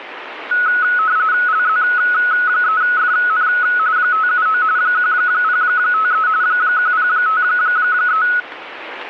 RTTY (45.45 baud, 170 Hz shift), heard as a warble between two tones, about 1380 Hz centre, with radio static. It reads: LZ3FN 579 1053 1053